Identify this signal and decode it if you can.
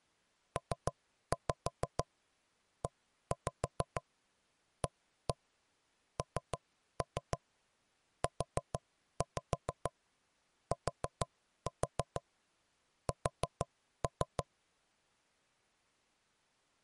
Tap code, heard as knocks on wood, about 6 knocks a second. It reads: PEANUTS